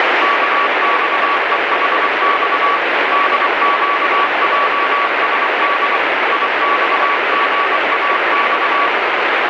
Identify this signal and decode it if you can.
Morse code, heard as a keyed tone, machine-sent, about 24 wpm, 1140 Hz, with heavy radio static. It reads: KXEHX DQJSD IXGAX